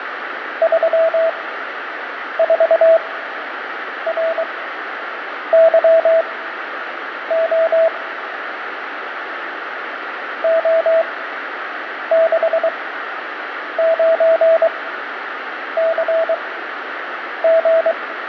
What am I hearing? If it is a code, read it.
Morse code, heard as a keyed tone, machine-sent, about 23 wpm, spaced as for 7 wpm, 650 Hz, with radio static and fading. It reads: 34RYO O69CG